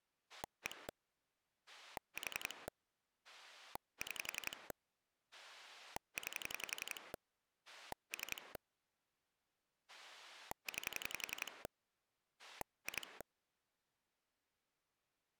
Pulse dialling, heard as a rotary dial, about 11 pulses a second. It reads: 1 4 6 9 3 9 2